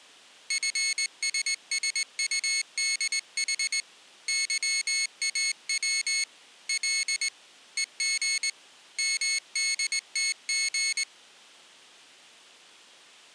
Morse code, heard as a high beeper, hand-sent with a straight key, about 20 wpm, 2200 Hz. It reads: FSSUDH YAW L EG MDTG